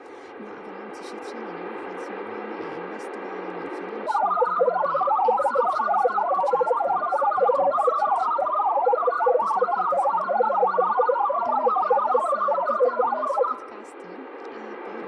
Multi-tone FSK (Olivia or MFSK type), about 1000 Hz wide, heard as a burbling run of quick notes, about 62.5 baud, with radio static.